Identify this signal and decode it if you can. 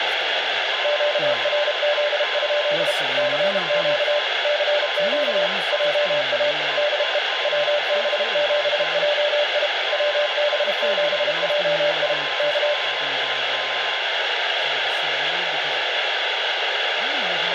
Morse code, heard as two keyed tones, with heavy radio static and speech in English. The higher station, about 8 wpm, 1040 Hz: QRL? CQ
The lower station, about 32 wpm, 590 Hz: QRZ? CQ CQ JA DE WB7JI WB7JI K